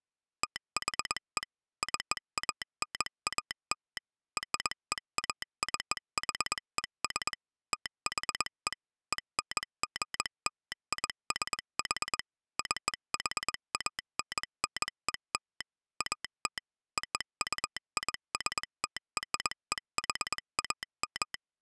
Morse code (American railroad code), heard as a telegraph sounder, machine-sent. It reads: THE CANAL REACHES THE ENGLISH CHANNEL AT OUISTREHAM